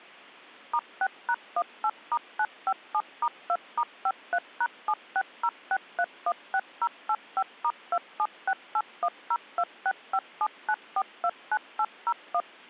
DTMF, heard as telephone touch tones, dialled by machine, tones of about 60 ms. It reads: *6#18*957*2*53#7606316085*27681026579429801